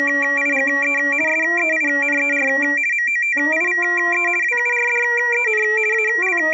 RTTY (50 baud, 450 Hz shift), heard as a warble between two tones, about 2150 Hz centre, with room echo. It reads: … SEINER MOTIVE WURDEN …